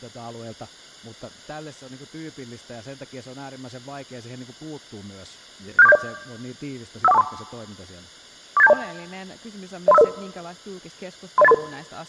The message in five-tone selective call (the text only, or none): 67470 51423 48720 03500 30833